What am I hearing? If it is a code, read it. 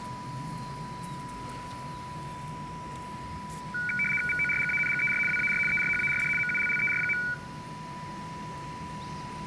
RTTY (75 baud, 850 Hz shift), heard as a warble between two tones, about 1900 Hz centre, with a steady whistle near 990 Hz, room echo and the noise of a residential street. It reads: VORGANGER WAR ERHARD MULLER.